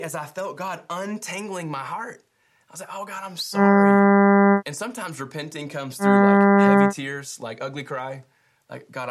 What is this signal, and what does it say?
Ship horn signal, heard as a ship's horn, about 200 Hz, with speech in English. 2 short. At sea: I am altering course to port.